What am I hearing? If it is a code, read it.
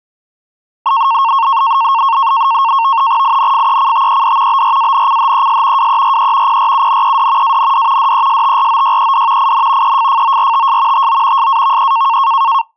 NAVTEX (SITOR-B), 100 baud, 170 Hz shift, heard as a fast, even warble, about 1000 Hz centre. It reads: INFECTED BRANCHES WERE PRUNED AND DESTROYED IN EFFORTS TO SAVE